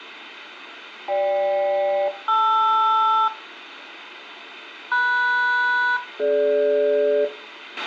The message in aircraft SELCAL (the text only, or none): GK-LR MS-DG